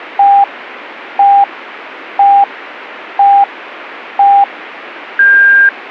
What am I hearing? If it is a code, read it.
Radio time signal (five pips and a higher one, as on Chinese radio), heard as pips.